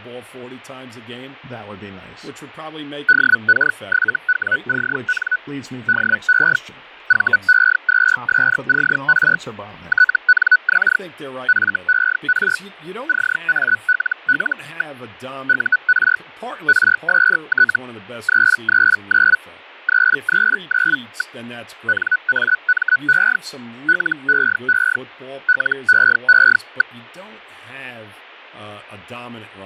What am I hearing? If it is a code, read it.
Hellschreiber (Feld-Hell, 122.5 baud), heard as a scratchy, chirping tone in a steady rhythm, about 1490 Hz, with fading and speech in English. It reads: DK7WCN DE VE2SCR TNX FER CALL. UR RST 339 339. NAME LEE LEE.